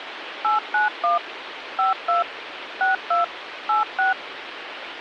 DTMF, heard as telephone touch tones, dialled by machine, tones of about 140 ms, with phone line noise. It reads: 891 52 62 86